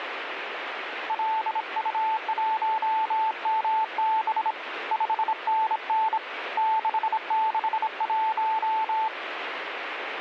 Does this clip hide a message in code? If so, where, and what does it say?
Yes: Morse code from 1.0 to 9.1 s, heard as a keyed tone, hand-sent with a bug key, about 26 wpm, 880 Hz, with radio static. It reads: LU1MB 5NN 661